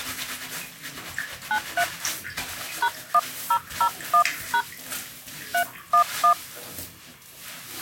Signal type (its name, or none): DTMF